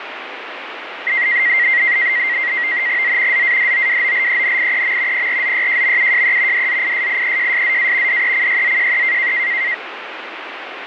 NAVTEX (SITOR-B), 100 baud, 170 Hz shift, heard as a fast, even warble, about 2000 Hz centre, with radio static. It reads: Z ZADOWOLENIEM PRZYJMUJE DZISIEJSZA DECYZJE